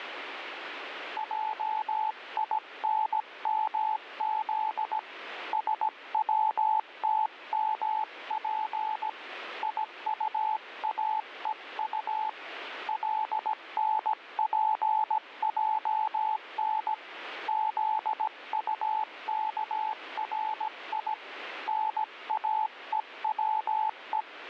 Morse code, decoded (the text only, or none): JINMZ SWTMP IUAEU LNPJN ZUKRI NAEWE